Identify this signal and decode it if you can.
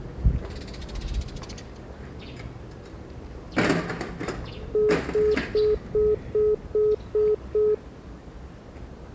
Telephone call progress tone (single-tone plan, as in most of Europe), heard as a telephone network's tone, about 420 Hz, 0.2 s on and 0.2 s off, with the noise of a residential street. Congestion tone.